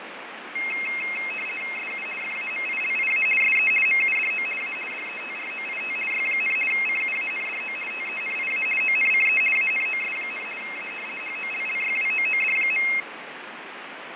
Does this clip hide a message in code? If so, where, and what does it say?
Yes: RTTY (50 baud, 450 Hz shift) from 0.6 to 13.0 s, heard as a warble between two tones, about 2350 Hz centre, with radio static and fading. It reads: SU FAMILIA SE MUDO A DETROIT Y, CUANDO TENIA ONCE ANOS, A HOLLYWOOD.